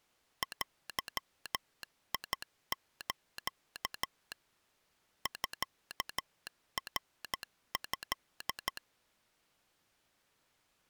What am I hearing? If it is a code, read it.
Morse code (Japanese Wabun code), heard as a telegraph sounder, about 13 wpm. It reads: デス ミナト